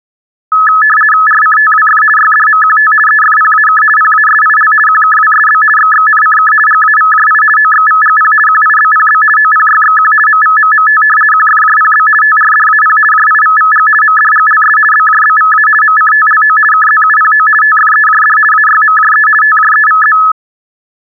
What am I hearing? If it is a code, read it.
RTTY (50 baud, 450 Hz shift), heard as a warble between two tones, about 1500 Hz centre. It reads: RCTWF YDMQT EFPAK PASIL QKWSB XXNCK GAVJI OXVGP QIBPB OPYXQ MVMMT QFJPB TRDAP JIVVG MDGLS BJBVA MCTLO KZUPO TFEJD AYMJE TJEVZ